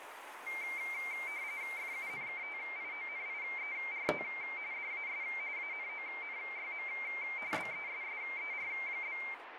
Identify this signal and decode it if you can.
RTTY (45.45 baud, 170 Hz shift), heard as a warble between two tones, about 2200 Hz centre, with radio static and kitchen noise. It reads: FUNKTIONIERT DAS ANONYM BESSER?